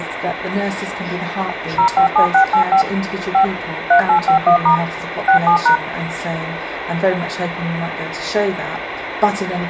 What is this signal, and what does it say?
DTMF, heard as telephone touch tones, dialled by machine, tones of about 100 ms, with phone line noise. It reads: 057685 5 3851* 67#